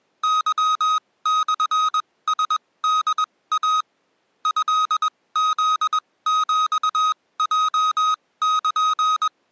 Morse code (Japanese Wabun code), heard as electronic beeps, machine-sent, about 21 wpm, spaced as for 17 wpm, 1260 Hz. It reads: ケモラホイ トフヒヲル